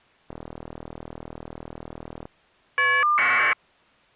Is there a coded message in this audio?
Yes: caller ID data burst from 0.3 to 3.5 s, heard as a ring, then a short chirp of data, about 1200 baud.